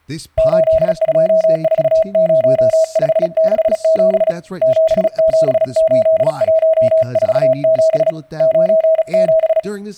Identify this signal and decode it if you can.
Morse code, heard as a keyed tone, hand-sent with a paddle, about 36 wpm, 640 Hz, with speech in English. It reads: 8240567 778147 97